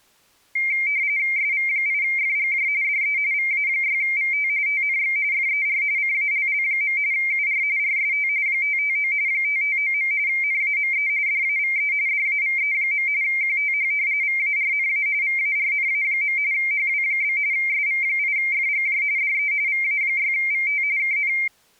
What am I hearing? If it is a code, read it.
RTTY (45.45 baud, 170 Hz shift), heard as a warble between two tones, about 2200 Hz centre. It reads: SV8FGJ DE VA6VT TNX FER CALL. UR RST 559 559. NAME DAVE DAVE. QTH VARNA VARNA. HW? SV8FGJ DE VA6VT KN